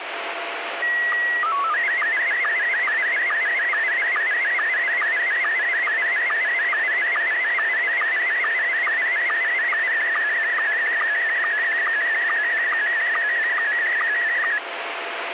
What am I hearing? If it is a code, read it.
SSTV (slow-scan television), Scottie S1, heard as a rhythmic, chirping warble, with radio static.